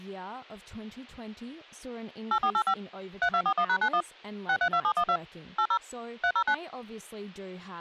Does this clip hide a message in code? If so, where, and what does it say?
Yes: DTMF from 2.3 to 6.5 s, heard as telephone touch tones, dialled by machine, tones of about 70 ms, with speech in English. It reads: 8485 3241#91 632712 80 309